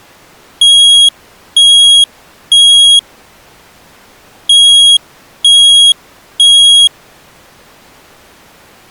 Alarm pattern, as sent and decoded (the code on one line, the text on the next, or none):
3 beeps and a pause
temporal three